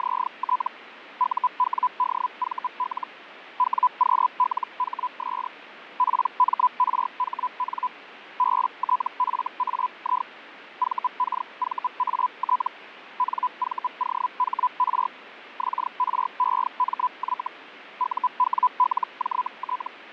Hellschreiber (Feld-Hell, 122.5 baud), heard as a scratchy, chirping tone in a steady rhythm, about 1000 Hz, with radio static and fading. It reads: … UWDVL WQLHS PMRHN BTFAI VKVAT NVOHR XREMY UWLJT